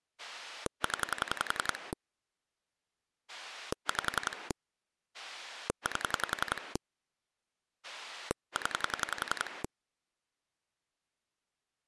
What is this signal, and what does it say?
Pulse dialling, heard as a rotary dial, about 11 pulses a second. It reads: 0 5 8 0